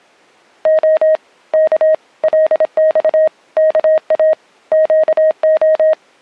Morse code (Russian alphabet), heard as a keyed tone, hand-sent with a paddle, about 26 wpm, 630 Hz. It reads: О К ЛЬ КА ЩО